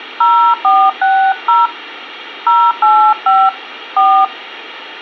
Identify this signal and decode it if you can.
DTMF, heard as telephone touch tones, dialled by hand, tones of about 280 ms. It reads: 0460 085 4